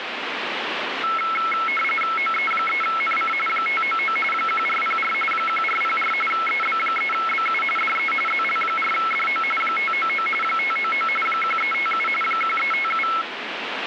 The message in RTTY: OE3NC 599 1404 1404 EB3BU DE ZL4DO 599 599 1357 1357

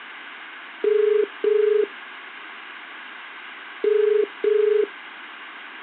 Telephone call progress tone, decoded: ringback tone

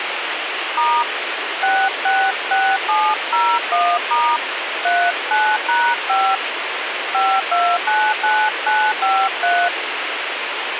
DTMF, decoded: * 666701* 39#5 5299953

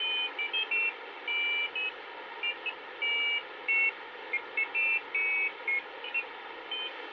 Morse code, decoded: none

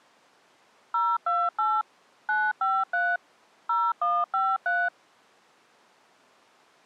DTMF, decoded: 028 953 0153

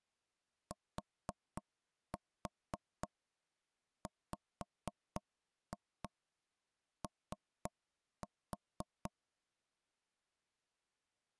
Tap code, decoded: TWO

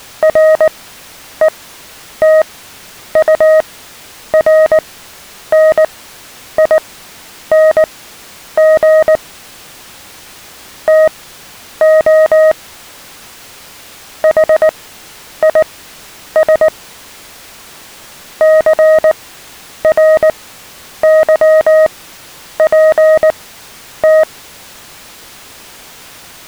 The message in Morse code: RETURNING TO HIS CRYPT

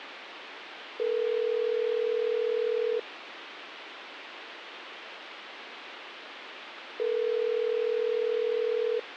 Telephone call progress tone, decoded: ringback tone

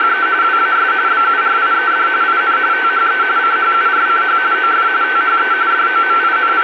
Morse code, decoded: none

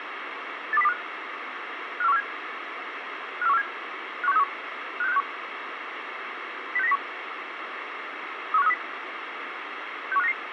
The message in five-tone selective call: 82025 54147 54147 51631 56561 06901 31530 61599

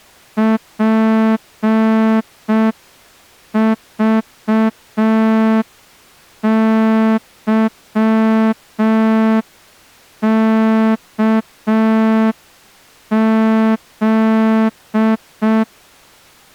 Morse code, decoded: PVYKZ

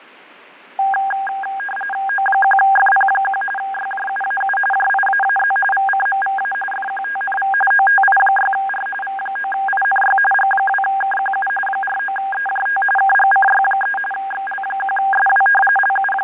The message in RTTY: O1FP1 YJUAU JIAAZ VCMVA FQTNV OTI6R V9INY G2KQU 49EJT KGCY3 XL1SW …

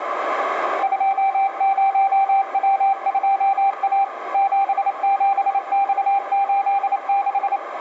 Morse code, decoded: 20W2A 77X86

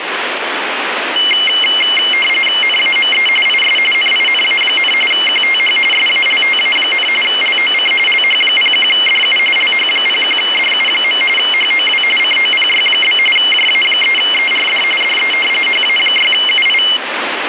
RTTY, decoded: NAME IS NINA, QTH SALTA, LOC LH01DU LH01DU. HOW COPY? JA3ERD DE HA6UI

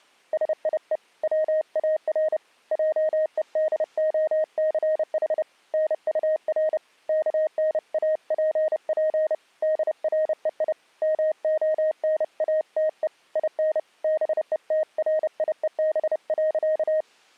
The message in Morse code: SIE WAR JEDOCH NUR KNAPP DREI MONATE IN BETRIEB.

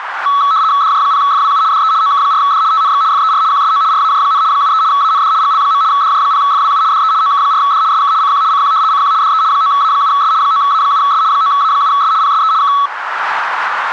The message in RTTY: DJ0FWU DE OK4D TNX FER QSO RAJ, 73 AND GL. DJ0FWU DE OK4D SK CQ CQ CQ DE 9A7S 9A7S 9A7S PSE K

